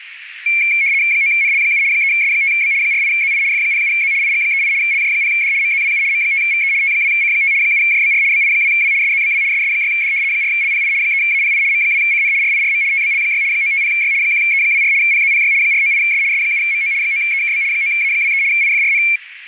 RTTY (75 baud, 170 Hz shift), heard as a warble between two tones, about 2250 Hz centre, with radio static. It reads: 9NL7 3S5B 48ZI F07Z IG38 LJ0D MZWU M5VE T2C5 7JBR BI2W SZBW SS6D 4LPI 3API M2CN RIRM TBL6 950Y 1E24 PZPY 498S S7MO 9EKB 9A23 IFRN